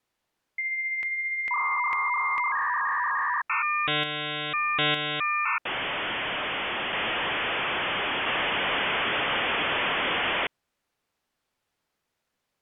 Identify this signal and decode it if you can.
Dial-up modem handshake (V.34 or later), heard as a whistle, warbles, then hiss.